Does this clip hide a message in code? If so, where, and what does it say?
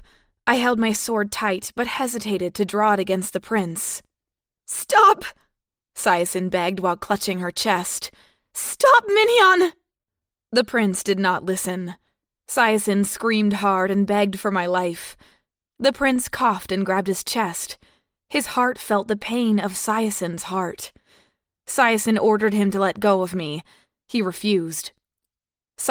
No.